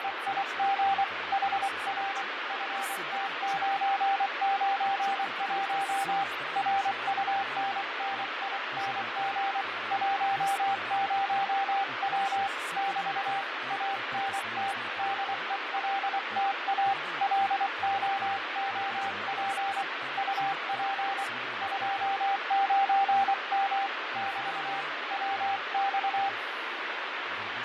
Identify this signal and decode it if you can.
Morse code, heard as a keyed tone, hand-sent with a paddle, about 24 wpm, 790 Hz, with heavy radio static, fading and speech in Bulgarian. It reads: … HR FT991 RUNNING 10W <BT> ANT DELTA LOOP UP 29M <BT> WX